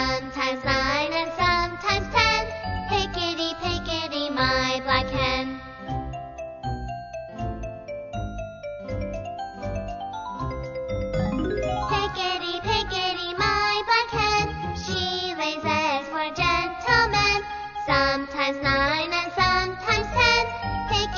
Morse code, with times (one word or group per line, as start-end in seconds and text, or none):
none